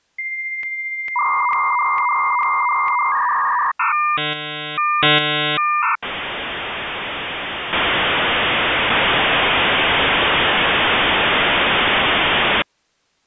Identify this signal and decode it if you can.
Dial-up modem handshake (V.34 or later), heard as a whistle, warbles, then hiss.